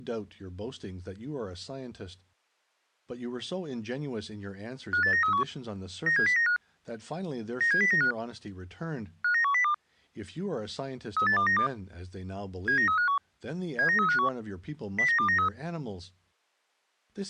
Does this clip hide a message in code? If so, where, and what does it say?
Yes: five-tone selective call (CCIR) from 4.9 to 15.5 s, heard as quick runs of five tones, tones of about 100 ms, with speech in English. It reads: 58931 97095 97095 59102 38292 79351 79351 09293